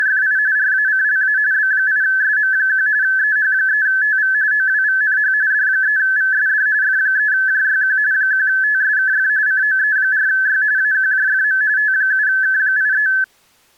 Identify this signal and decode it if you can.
RTTY (45.45 baud, 170 Hz shift), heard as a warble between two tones, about 1600 Hz centre. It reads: … RACLA B8SM1 EH3TV OWVNH D3VSD F3JYQ 1TSKF COE4Y AQJFM T7K83